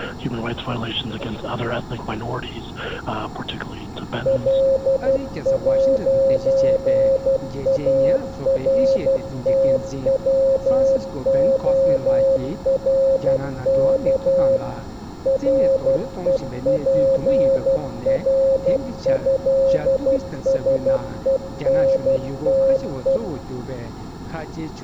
Morse code (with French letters), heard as a keyed tone, machine-sent, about 12 wpm, 540 Hz, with room echo. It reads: L'ARTWORK REPRÉSENTE